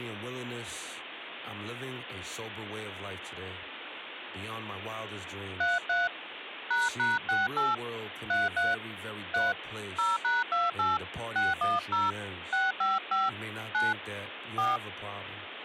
DTMF, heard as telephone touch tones, dialled by hand, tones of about 180 ms, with phone line noise and speech in English. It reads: 33 ##68 33 3 0#28 610 655 9 4